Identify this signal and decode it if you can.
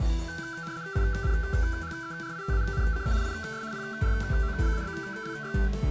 RTTY (75 baud, 170 Hz shift), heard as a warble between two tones, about 1440 Hz centre. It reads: INHERITANCE IS PROBABLY